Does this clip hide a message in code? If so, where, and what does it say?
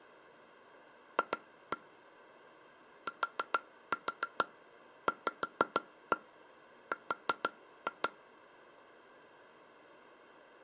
Yes: tap code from 1.2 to 8.1 s, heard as taps on glass, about 6 knocks a second. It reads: F TVR